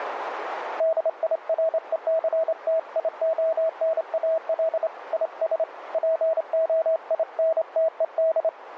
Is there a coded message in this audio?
Yes: Morse code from 0.7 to 8.5 s, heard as a keyed tone, hand-sent with a straight key, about 27 wpm, 650 Hz, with radio static and a narrow filter. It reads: DIRECTIONAL IS POINTED